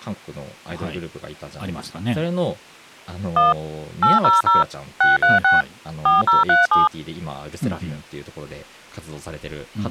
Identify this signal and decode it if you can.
DTMF, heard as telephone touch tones, dialled by machine, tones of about 160 ms, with speech in Japanese. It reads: 1 800 636 4037